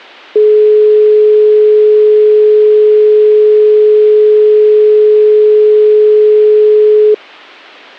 Telephone call progress tone (425 Hz plan, as in most of Europe), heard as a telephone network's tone, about 420 Hz. Dial tone.